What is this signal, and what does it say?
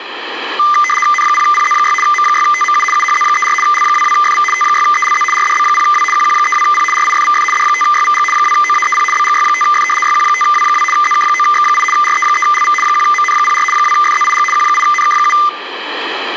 RTTY (75 baud, 850 Hz shift), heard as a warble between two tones, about 1600 Hz centre, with radio static. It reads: N0PZ6 M6TMU UHZ34 L22FV T6ELZ RDB0W QQ32P RIFVF D5YVG 2OAEP BGY5F YQ5W2 ZK9X8 RE3LV 1MN04 2FZIG Q8NK7